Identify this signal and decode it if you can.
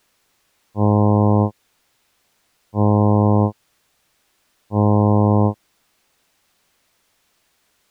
Ship horn signal, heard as a ship's horn, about 100 Hz. 3 short. At sea: I am operating astern propulsion.